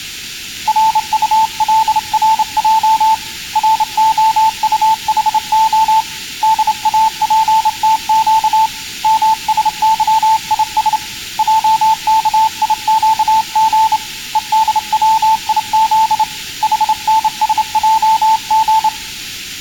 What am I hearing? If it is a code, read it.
Morse code, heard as a keyed tone, hand-sent with a straight key, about 28 wpm, 880 Hz. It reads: RULRJ ROUHO DAPTQ MSYIS JKIQG EDWIZ HNSJG